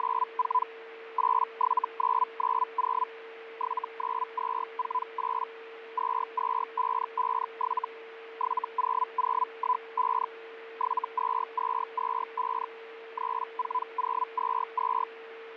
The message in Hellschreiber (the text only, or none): … 87990 79248 22557 70015 72225 34022